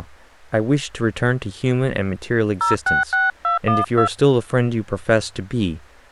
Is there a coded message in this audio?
Yes: DTMF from 2.6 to 4.1 s, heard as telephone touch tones, dialled by hand, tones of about 150 ms, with speech in English. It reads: 066212